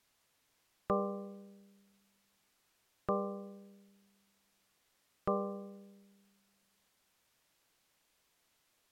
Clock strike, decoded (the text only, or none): 3